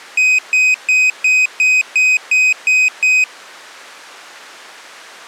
Beep code, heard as a piezo beeper, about 2500 Hz. 9 short. In AMI BIOS tables: ROM checksum failure.